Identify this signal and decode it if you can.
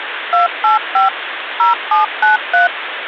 DTMF, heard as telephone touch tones, dialled by machine, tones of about 140 ms, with phone line noise. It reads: 285 0793